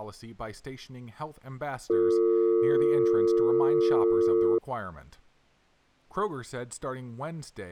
Telephone call progress tone (North American or UK plan), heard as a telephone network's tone, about 350, 450 Hz, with speech in English. Dial tone.